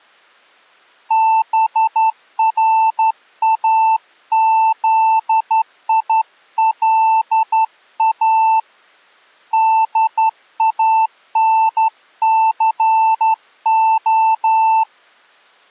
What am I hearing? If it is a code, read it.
Morse code, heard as a keyed tone, hand-sent with a straight key, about 11 wpm, 890 Hz. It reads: BRAZILA DANCO